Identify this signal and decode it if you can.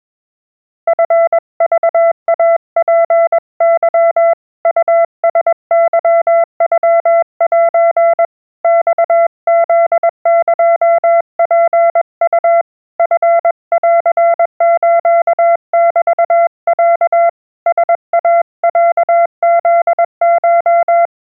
Morse code (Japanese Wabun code), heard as a keyed tone, hand-sent with a paddle, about 21 wpm, 680 Hz. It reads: チクイツケ ウラケノセ マフエツウ チンスメロ ライロフコ